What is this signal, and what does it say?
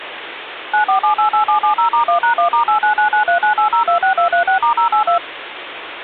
DTMF, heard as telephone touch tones, dialled by machine, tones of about 110 ms, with phone line noise. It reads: 94788770*1#1*8999398026236*082